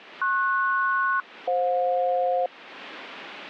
Aircraft SELCAL, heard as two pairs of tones, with radio static. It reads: PS-FJ